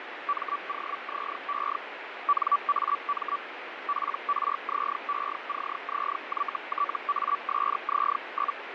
Hellschreiber (Feld-Hell, 122.5 baud), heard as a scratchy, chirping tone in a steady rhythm, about 1150 Hz, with radio static and fading. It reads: MOZE NAM PRZECZYTASZ?